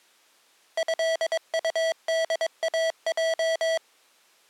Morse code (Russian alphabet), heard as electronic beeps, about 22 wpm, 650 Hz. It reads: ЭУДАЙ